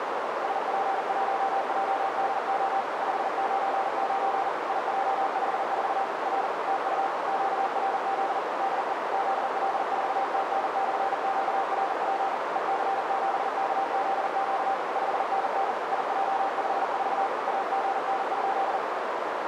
Morse code, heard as a keyed tone, machine-sent, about 40 wpm, 780 Hz, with heavy radio static and a narrow filter. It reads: SP1JDO 599 IJ54 R TU QRZ DE ZL4TN/QRP EC7KZQ 5NN IJ54 AGN?